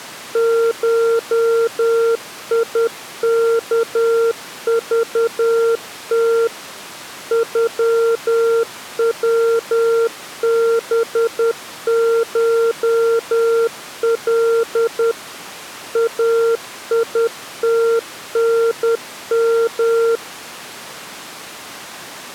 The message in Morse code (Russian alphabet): ШИКЖТ ЮВБШЛ АИТНМ

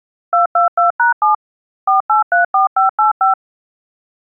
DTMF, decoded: 222#7 4834585

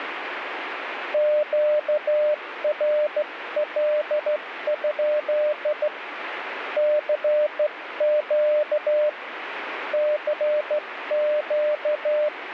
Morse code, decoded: QRL? CQ CQ

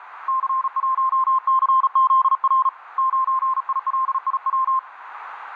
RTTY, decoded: none

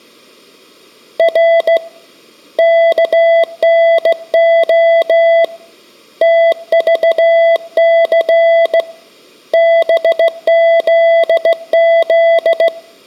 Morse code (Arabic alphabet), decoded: ر كنخ تضث بذذ

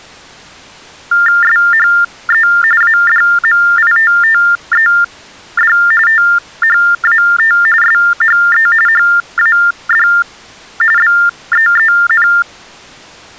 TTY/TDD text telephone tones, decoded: SHE ADMITTED THAT SHE HAD BEEN

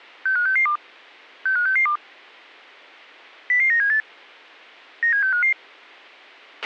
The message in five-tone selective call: 65662 65662 00978 97655

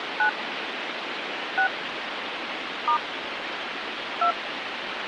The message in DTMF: 9 6 * 2

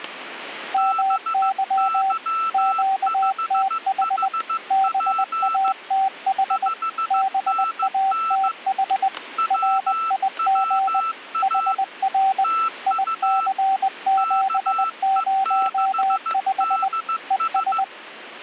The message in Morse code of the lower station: MY QTH BATH BATH RIG HR IC705 ES

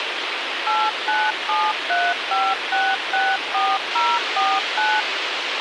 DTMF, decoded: 89735664049

